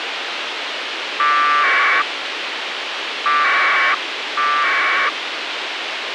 Packet radio (AX.25, as in APRS), 1200 baud, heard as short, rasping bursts, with radio hiss.